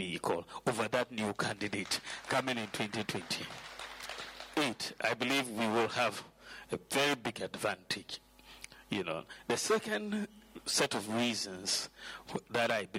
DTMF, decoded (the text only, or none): none